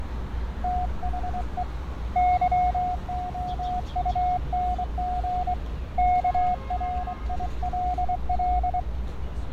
Morse code, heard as a keyed tone, hand-sent with a straight key, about 24 wpm, 720 Hz, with radio static, fading and street noise. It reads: THE YOUNG KRILL